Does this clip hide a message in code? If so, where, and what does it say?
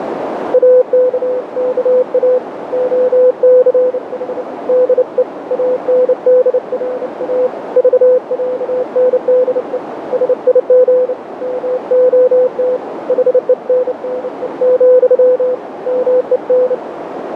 Yes: Morse code (with Swedish letters) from 0.5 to 16.8 s, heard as a keyed tone, hand-sent with a bug key, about 29 wpm, 500 Hz, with heavy radio static and a narrow filter. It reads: AKKA OCH DE ANDRA VÄNDE SIG MOT HENNE, MEN